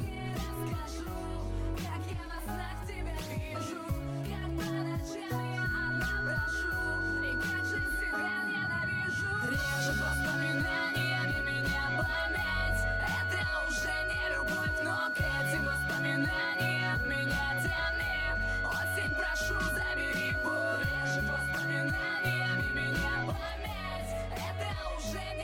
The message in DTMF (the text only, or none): none